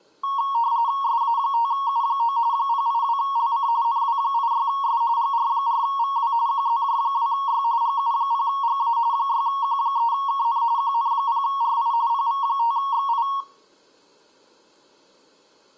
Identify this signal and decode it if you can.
RTTY (45.45 baud, 170 Hz shift), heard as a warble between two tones, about 1020 Hz centre, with room echo. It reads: SA5U9 082LC NW86S GR4VW QZJ2Y GU0GA 6Q3KN QN0RI PV5XI